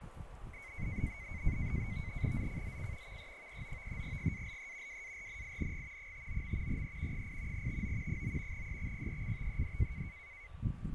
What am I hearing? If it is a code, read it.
NAVTEX (SITOR-B), 100 baud, 170 Hz shift, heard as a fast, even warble, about 2150 Hz centre, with radio static, fading and a steady whistle near 1160 Hz. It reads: ZCZC VE39 GALE WARNING 59. E 8 TO 9 EXPECTED